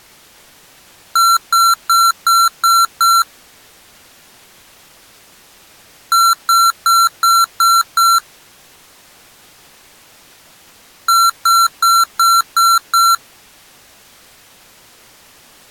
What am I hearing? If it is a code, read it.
Beep code, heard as beeps from a small speaker, played three times, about 1360 Hz. 6 short. In AMI BIOS tables: keyboard controller gate A20 failure; in Dell tables: video card failure.